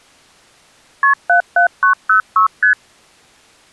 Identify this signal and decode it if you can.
Multi-frequency trunk signalling (R1, as on North American trunks), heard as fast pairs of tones, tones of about 110 ms. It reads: KP 77906 ST